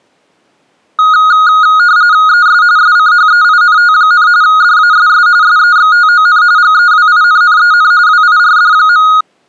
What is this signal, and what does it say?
RTTY (45.45 baud, 170 Hz shift), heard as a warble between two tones, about 1350 Hz centre. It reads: ES SCHEINT, DASS SEXTON GEWINNEN WIRD.